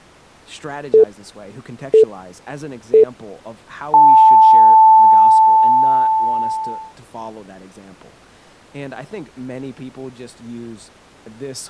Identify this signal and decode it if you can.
Radio time signal (three low pips and a long one an octave up, as on NHK), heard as pips, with speech in English.